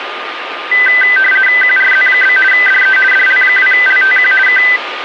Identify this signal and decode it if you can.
RTTY (50 baud, 450 Hz shift), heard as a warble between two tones, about 1800 Hz centre, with radio static and a steady whistle near 1220 Hz. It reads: QRZ? DE DL2LTQ K